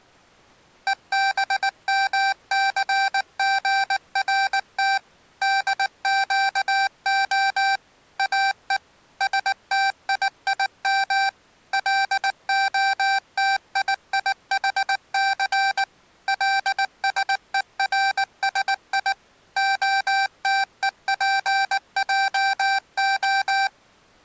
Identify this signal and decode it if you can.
Morse code (Hebrew alphabet), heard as electronic beeps, machine-sent, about 19 wpm, 780 Hz. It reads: ובמסגרת דקה או שתיים להתייחס לשורשי התופעה